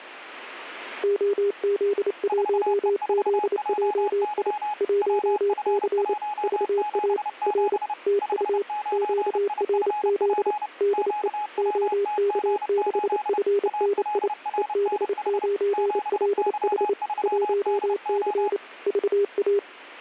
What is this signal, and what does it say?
Morse code, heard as two keyed tones. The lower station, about 28 wpm, 400 Hz: OZ1ZJI 1C VA R TU QRZ DE OK6FNI EB9LH 1C VA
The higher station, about 30 wpm, 840 Hz: 4E4JY WF177 59IFP QWTG8 ALRNH 7Y3DO